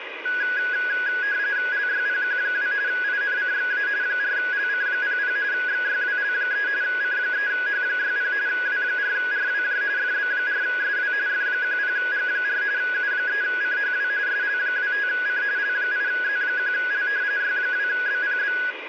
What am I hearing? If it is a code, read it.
RTTY (45.45 baud, 170 Hz shift), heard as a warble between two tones, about 1550 Hz centre, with radio static. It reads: LYPQ2 INCXA 4LC00 XYWL3 C3H60 W4RWJ FB4SW F10G4 U3CHW SL25C L8Z1L Y2BPB